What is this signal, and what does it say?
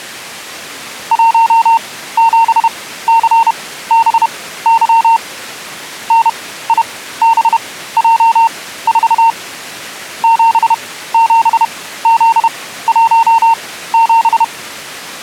Morse code, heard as a keyed tone, machine-sent, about 31 wpm, spaced as for 16 wpm, 910 Hz. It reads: 17CBY NIBJ4 77Z17